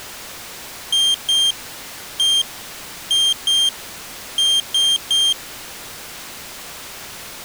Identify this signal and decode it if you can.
Beep code, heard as a piezo beeper, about 3200 Hz. 2-1-2-3. In Phoenix BIOS tables: ROM copyright notice check failure.